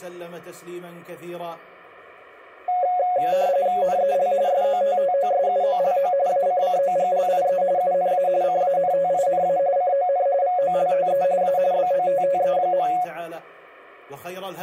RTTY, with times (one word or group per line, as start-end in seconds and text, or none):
3.8-4.3 NEL
4.5-6.1 SOTTOSUOLO
6.3-7.6 ACCOGLIE
7.8-8.3 UNA
8.4-9.6 CANTINA
9.8-10.3 CON
10.4-11.2 VOLTE
11.4-11.6 A
11.7-12.9 BOTTE.